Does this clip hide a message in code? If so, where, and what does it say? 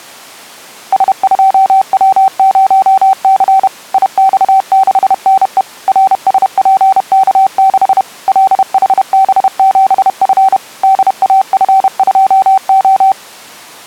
Yes: Morse code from 0.9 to 13.2 s, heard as a keyed tone, machine-sent, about 31 wpm, 770 Hz. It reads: S2W0C IX6NE RSPK6 LHB7F DAF2O